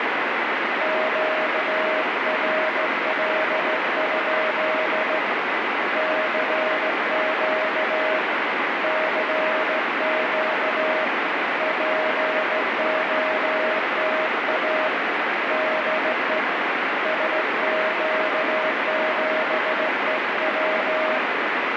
Morse code, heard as a keyed tone, hand-sent with a straight key, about 15 wpm, 630 Hz, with heavy radio static. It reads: QRL? CQ CQ POTA DE SQ7EW